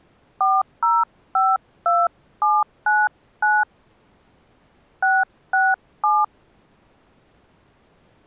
DTMF, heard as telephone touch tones, dialled by hand, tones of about 210 ms. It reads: 4052799 667